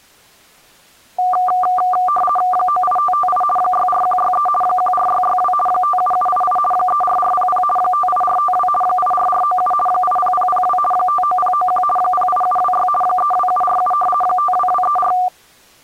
RTTY (50 baud, 450 Hz shift), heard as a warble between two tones, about 960 Hz centre. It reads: 98558 64163 14662 57788 34400 58452 84497 80002 59091 08726 32747 52234